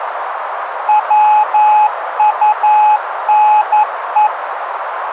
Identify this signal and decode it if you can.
Morse code, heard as a keyed tone, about 11 wpm, 850 Hz, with radio static and a narrow filter. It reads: WUNE